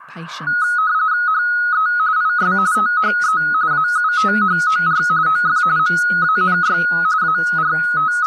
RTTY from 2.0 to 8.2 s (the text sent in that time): IS THE AUTHOR OF MANY …